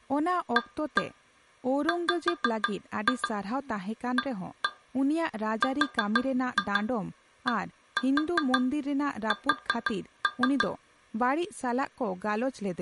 Tap code, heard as taps on glass, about 6 knocks a second, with speech in Santali. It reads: AWARDS